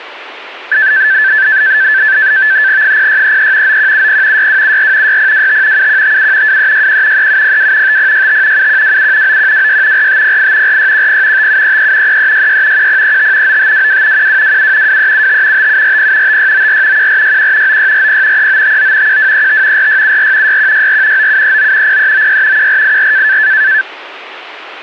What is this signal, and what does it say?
NAVTEX (SITOR-B), 100 baud, 170 Hz shift, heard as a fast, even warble, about 1650 Hz centre. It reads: 0633 9170 6274 6025 7157 2361 3702 5065 7127 9126 4508 4610 5733 3366 1035 9522 1227 2375 5740 5694 1461 9640 3959 1235 4674 6164 9739 0396 1484